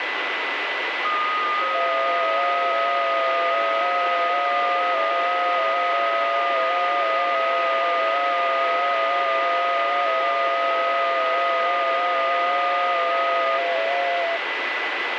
FT8 (several signals at once), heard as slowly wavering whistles, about 6.25 baud, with radio static and a steady whistle near 2000 Hz.